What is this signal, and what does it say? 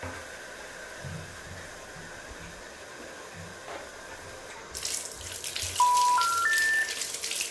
Telephone call progress tone (North American plan), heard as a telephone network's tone, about 980, 1370, 1800 Hz, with room echo and the noise of a restroom. Special information tone.